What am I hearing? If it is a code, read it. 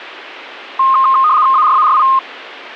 RTTY (75 baud, 170 Hz shift), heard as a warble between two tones, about 1150 Hz centre. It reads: ARARI